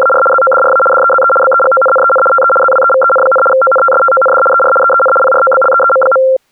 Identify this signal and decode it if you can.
RTTY (75 baud, 850 Hz shift), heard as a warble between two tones, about 950 Hz centre. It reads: … ZODRA DEZE BEGONNEN TE ZWEVEN, ONTSTOND ER EEN PROBLEEM.